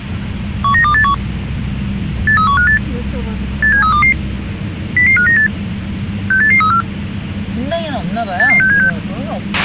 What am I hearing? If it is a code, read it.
Five-tone selective call (CCIR), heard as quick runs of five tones, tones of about 100 ms, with a squelch burst at the end and the noise inside a car. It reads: 19281 83158 87322 00598 68834 88676